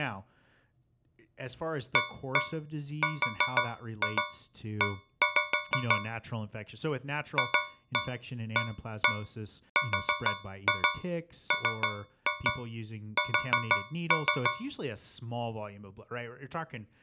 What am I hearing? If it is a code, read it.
Tap code, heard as taps on a metal pipe, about 6 knocks a second, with speech in English. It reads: ARE FARMS